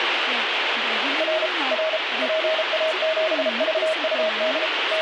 Morse code, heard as a keyed tone, machine-sent, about 33 wpm, 630 Hz, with heavy radio static and speech in Bodo. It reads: R R PA7VUD …